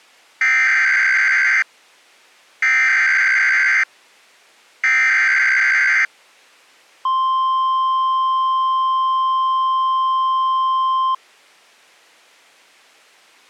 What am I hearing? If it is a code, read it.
Emergency Alert System (SAME) tones (header bursts, then the 1050 Hz attention tone), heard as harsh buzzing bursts, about 520.83 baud.